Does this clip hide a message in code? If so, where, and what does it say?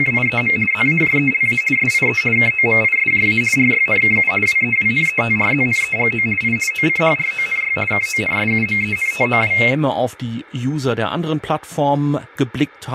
Yes: RTTY (50 baud, 450 Hz shift) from 0.0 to 9.7 s, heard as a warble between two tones, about 2350 Hz centre, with speech in German. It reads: … ZAJELA SIE KOMISJA RYNKU WEWNETRZNEGO I OCHRONY KONSUMENTOW